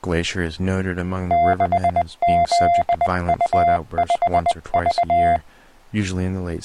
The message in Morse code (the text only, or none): 6ZU5V